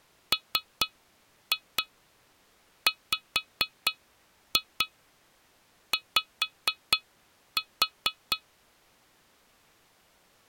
Tap code, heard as taps on glass, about 4 knocks a second. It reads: MWY